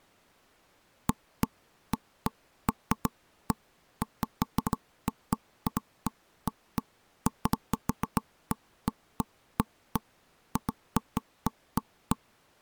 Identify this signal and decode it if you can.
Irregular knocks on wood. There is no code.